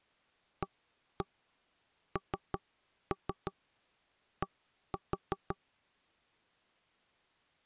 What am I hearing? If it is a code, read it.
Tap code, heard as knocks on wood, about 5 knocks a second. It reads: AND